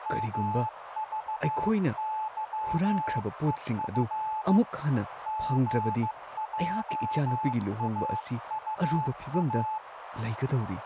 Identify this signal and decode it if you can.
Morse code, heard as a keyed tone, hand-sent with a bug key, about 15 wpm, 870 Hz, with radio static, a narrow filter and speech in Manipuri. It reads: MVYEF GJAUA